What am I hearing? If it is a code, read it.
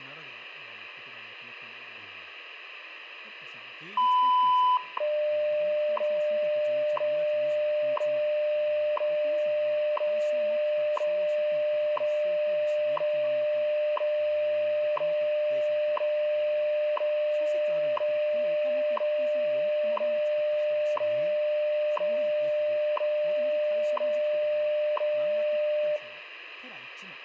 Radio time signal (WWV, Colorado), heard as ticks, one a second, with radio static, room echo and speech in Japanese.